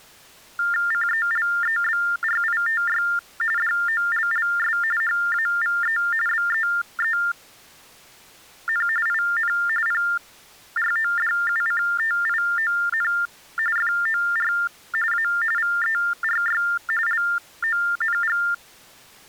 TTY/TDD text telephone tones (45.45 baud Baudot), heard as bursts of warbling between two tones, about 400 Hz shift, 1600 Hz centre. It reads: CELEBRITY DOLLS HAVE BEEN IN PRODUCTION FOR A VERY LONG